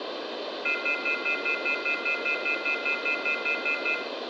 Telephone call progress tone (North American plan), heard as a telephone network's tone, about 1400, 2050, 2450, 2600 Hz, 0.1 s on and 0.1 s off, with phone line noise and room echo. Off-hook warning tone.